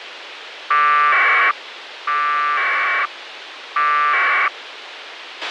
Packet radio (AX.25, as in APRS), 1200 baud, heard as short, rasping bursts, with radio hiss and a squelch burst at the end.